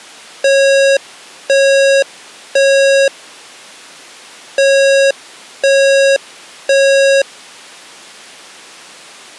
Alarm pattern, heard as an alarm's beeps, played twice, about 550 Hz. Temporal three. Smoke or fire, evacuate.